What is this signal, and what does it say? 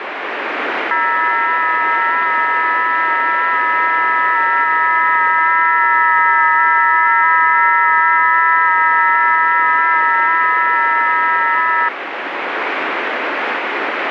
FT8 (several signals at once), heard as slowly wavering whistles, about 6.25 baud, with radio static.